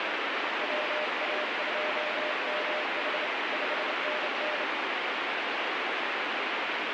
Morse code, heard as a keyed tone, hand-sent with a straight key, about 28 wpm, 610 Hz, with heavy radio static. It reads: WA2MH 5NN